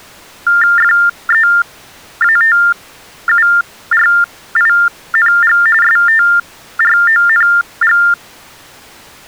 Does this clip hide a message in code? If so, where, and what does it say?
Yes: TTY/TDD text telephone tones (45.45 baud Baudot) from 0.5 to 8.1 s, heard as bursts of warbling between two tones, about 400 Hz shift, 1600 Hz centre. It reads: FEATURING STRONG